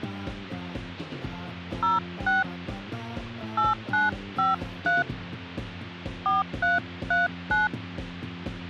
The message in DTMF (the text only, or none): 06 8953 4339